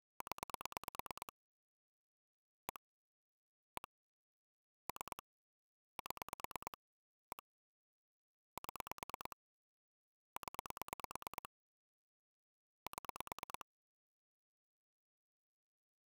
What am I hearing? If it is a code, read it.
Pulse dialling, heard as clicks on a phone line, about 9 pulses a second. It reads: 0 1 1 3 7 1 7 0 7